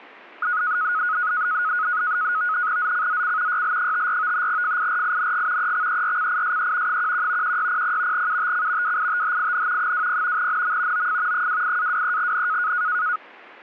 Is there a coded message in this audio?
Yes: NAVTEX (SITOR-B), 100 baud, 170 Hz shift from 0.4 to 13.2 s, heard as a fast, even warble, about 1360 Hz centre. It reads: ZCZC YL54 FIRING EXERCISE 11 1600 UTC WITHIN 20 NM OF 28-23N